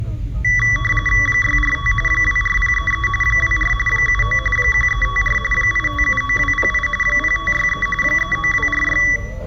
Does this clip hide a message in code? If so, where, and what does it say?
Yes: RTTY (45.45 baud, 850 Hz shift) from 0.4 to 9.2 s, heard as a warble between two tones, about 1550 Hz centre, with room echo and the noise inside a car. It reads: 645 24033 24 79 1354 8579208 0563 39246